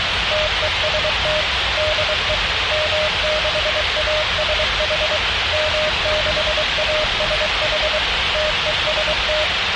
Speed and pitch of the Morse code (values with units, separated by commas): 23 wpm, 610 Hz